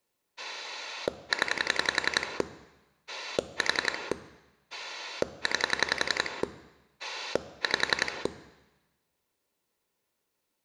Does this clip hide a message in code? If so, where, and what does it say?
Yes: pulse dialling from 0.4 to 8.3 s, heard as a rotary dial, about 11 pulses a second, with room echo. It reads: 0 4 9 5